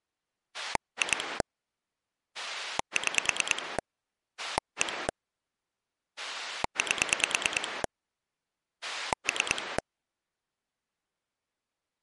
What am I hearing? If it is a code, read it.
Pulse dialling, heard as a rotary dial, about 9 pulses a second. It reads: 2 6 1 8 3